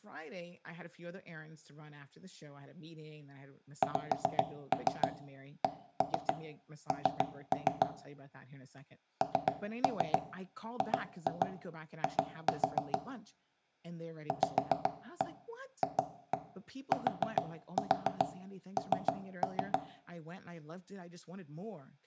Tap code, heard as knocks on wood, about 7 knocks a second, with room echo and speech in English. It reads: XCN NGI VFTN